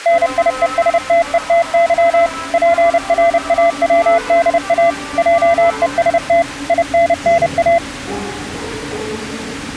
Morse code, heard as a keyed tone, machine-sent, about 30 wpm, 680 Hz, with the noise of a subway station. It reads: NIESTETY PRAWDA JEST INNA